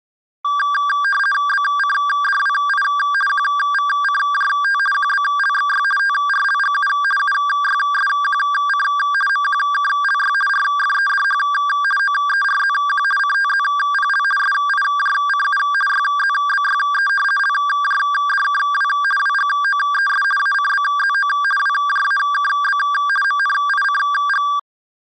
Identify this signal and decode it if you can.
RTTY (50 baud, 450 Hz shift), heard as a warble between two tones, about 1380 Hz centre. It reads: BCDWI QVCJT QBLXY TRLGU UYSQC MQKLY RFEDH OERZQ CTZPL SIJCU YZBYE LJDKW WGOES ACBZO WJAKB MNICG